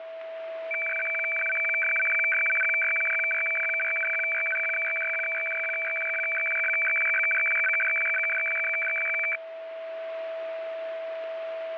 Weather fax (radiofax), 120 lines a minute, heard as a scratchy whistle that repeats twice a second, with radio static and a steady whistle near 650 Hz.